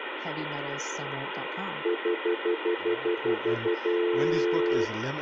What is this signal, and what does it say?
Telephone call progress tone (North American plan), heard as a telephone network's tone, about 350, 440 Hz, 0.1 s on and 0.1 s off, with phone line noise and speech in English. Stutter dial tone.